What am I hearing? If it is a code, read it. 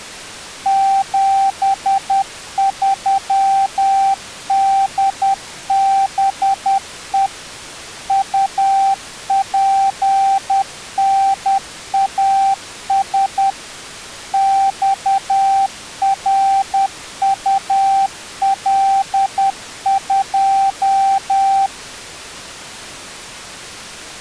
Morse code, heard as a keyed tone, machine-sent, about 10 wpm, 780 Hz. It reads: 73DBE UPNAS XRUL2